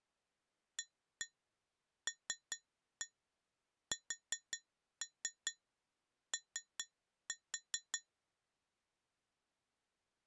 Tap code, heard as taps on glass, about 5 knocks a second. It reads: ALSO